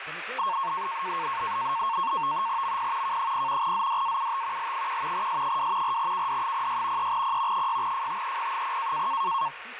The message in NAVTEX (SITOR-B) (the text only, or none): MP K0 ZDAUT L1 S2 4KD06 3P 6FTEP0